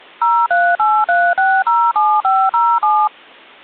DTMF, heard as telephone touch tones, dialled by machine, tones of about 250 ms. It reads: 0383607507